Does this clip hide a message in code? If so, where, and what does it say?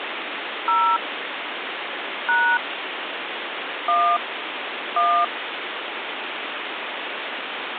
Yes: DTMF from 0.7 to 5.2 s, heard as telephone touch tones, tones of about 280 ms, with phone line noise. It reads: 0 # 1 1